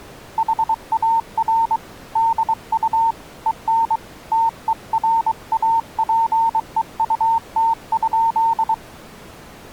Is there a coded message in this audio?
Yes: Morse code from 0.3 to 8.8 s, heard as a keyed tone, hand-sent with a paddle, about 23 wpm, 910 Hz. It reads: HAR DU EN TERAPEUT?